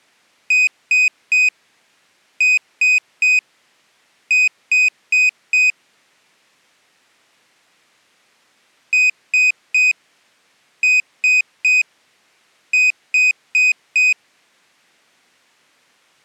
Beep code, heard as a piezo beeper, played twice, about 2500 Hz. 3-3-4. In Phoenix BIOS tables: video failure.